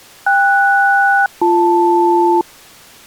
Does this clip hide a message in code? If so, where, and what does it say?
Yes: aircraft SELCAL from 0.3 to 2.4 s, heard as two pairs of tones. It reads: KS-BL